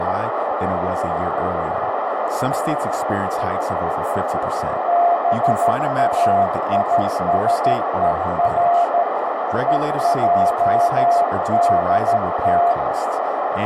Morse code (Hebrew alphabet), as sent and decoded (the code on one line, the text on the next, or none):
-... .- .. ... . .-. / . .--- -.. -
באישור ועדת